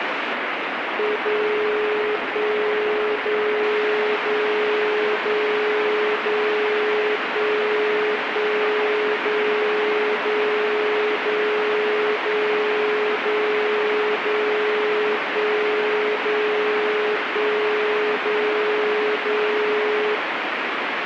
Radio time signal (DCF77), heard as a tone whose level steps once a second, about 420 Hz, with radio static. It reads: 0 1 0 0 0 0 1 1 0 0 0 0 0 0 1 0 1 0 0